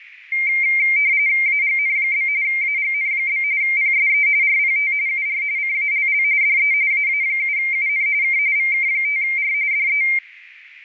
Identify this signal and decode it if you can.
RTTY (45.45 baud, 170 Hz shift), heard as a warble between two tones, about 2200 Hz centre, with radio static. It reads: AGN? AGN? PSE RPT UR CALL DE AA7UN K VK5R DE